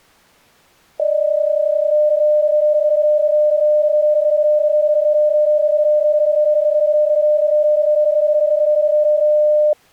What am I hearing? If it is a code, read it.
PSK31 (31.25 baud), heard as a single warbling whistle, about 600 Hz.